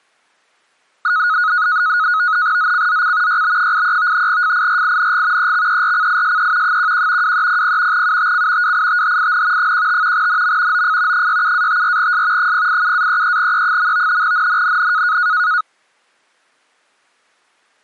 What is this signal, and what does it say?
NAVTEX (SITOR-B), 100 baud, 170 Hz shift, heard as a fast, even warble, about 1360 Hz centre. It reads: ZCZC YB83 FIRING EXERCISE 11 2300 UTC WITHIN 15 NM OF 67-54S 087-33E. NNNN